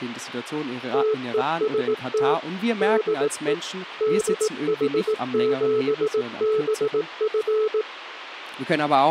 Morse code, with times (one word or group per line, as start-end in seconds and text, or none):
0.9-2.3 TEST
2.8-3.5 DE
4.0-7.8 DH7BF